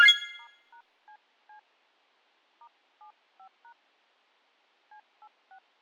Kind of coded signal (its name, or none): DTMF